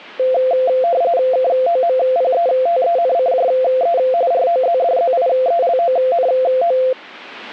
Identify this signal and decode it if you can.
RTTY (45.45 baud, 170 Hz shift), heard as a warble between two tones, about 600 Hz centre. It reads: KOMPETENCJE ROZDZIELONO